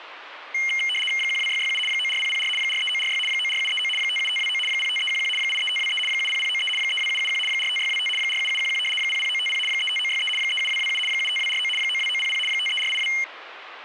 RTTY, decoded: 12667 94004 43946 94739 57529 05311 83523 70093 32771 45625 47711 00950 35963 37227 75249 92900 53482

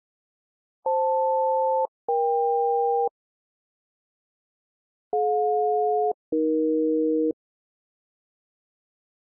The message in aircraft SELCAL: FL-EK DJ-AE

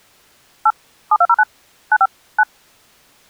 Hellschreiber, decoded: none

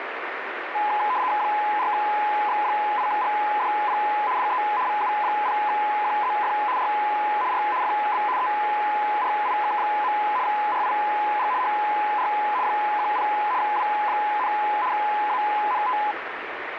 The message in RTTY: 4X8GDP DE VU0QZF R R FB ERIK. RIG HR 10 W, ANT

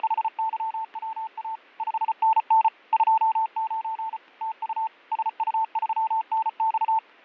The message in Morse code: … 5NN 29 TU SU3NX

